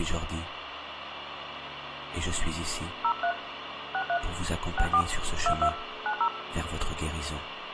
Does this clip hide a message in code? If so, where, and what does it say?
Yes: DTMF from 3.0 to 6.3 s, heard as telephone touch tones, dialled by hand, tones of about 80 ms, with radio hiss and room echo. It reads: 03 63 64 22 90